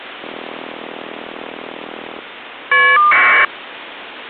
Caller ID data burst, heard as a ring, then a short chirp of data, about 1200 baud, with phone line noise.